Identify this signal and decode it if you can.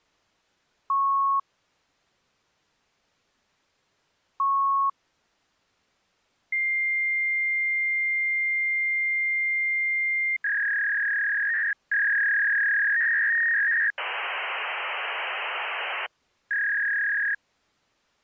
Fax machine handshake, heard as beeps, a long tone, a warble and hiss.